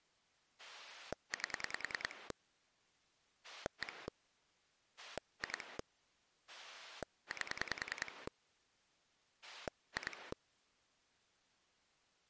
Pulse dialling, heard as a rotary dial, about 10 pulses a second. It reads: 8 1 2 8 2